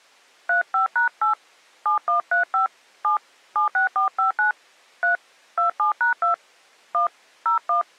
DTMF, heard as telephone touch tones, dialled by hand, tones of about 120 ms. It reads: 35#8 7135 7 76459 3 27#2 1 01